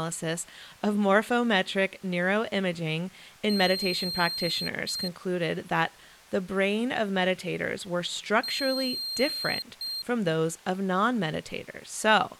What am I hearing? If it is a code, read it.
Beep code, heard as a piezo beeper, played twice, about 4200 Hz, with speech in English. 1 long, 1 short. In IBM BIOS tables: system board problem.